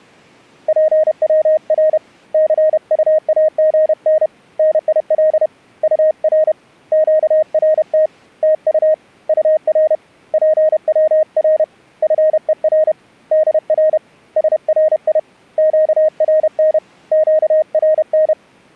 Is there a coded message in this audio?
Yes: Morse code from 0.6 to 18.4 s, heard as a keyed tone, hand-sent with a paddle, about 31 wpm, 620 Hz. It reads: PWR CUAGN NIL UR QRT TU UR PWR FER DR SRI QRN QRN